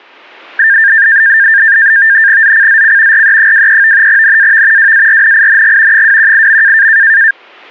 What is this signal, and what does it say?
NAVTEX (SITOR-B), 100 baud, 170 Hz shift, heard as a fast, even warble, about 1700 Hz centre. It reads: ZCZC RE23 NAV WARNING 218.